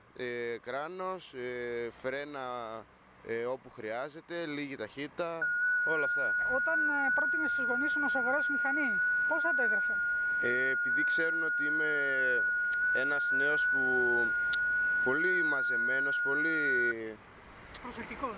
FT8 (one signal), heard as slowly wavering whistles, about 6.25 baud.